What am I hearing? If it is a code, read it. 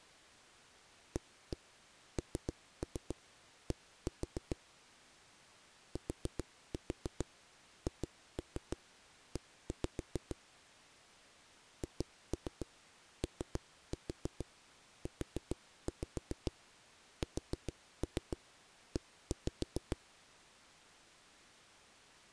Tap code, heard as knocks on a wall, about 7 knocks a second. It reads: AND THE HOUSE